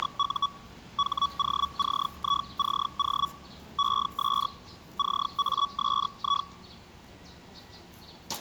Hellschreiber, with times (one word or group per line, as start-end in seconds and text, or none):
0.0-0.5 …
1.0-3.3 HOCICO
3.8-4.5 ES
5.0-6.5 CASI